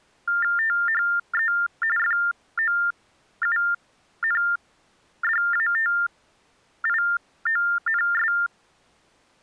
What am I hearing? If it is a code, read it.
TTY/TDD text telephone tones (45.45 baud Baudot), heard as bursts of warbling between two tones, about 400 Hz shift, 1600 Hz centre. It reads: THE FOUNDATIONS